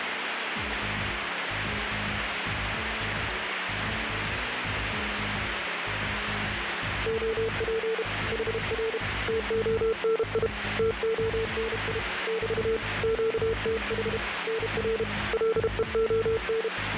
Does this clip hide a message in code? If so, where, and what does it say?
Yes: Morse code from 7.0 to 16.7 s, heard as a keyed tone, hand-sent with a paddle, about 32 wpm, 450 Hz, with radio static. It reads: OP HR TONI TONI <BT> QTH NR LEON